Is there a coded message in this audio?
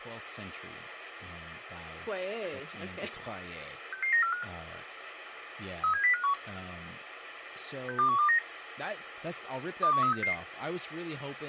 Yes: five-tone selective call (CCIR) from 3.9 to 10.3 s, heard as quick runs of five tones, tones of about 100 ms, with radio hiss and speech in English. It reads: 66945 37051 62129 21366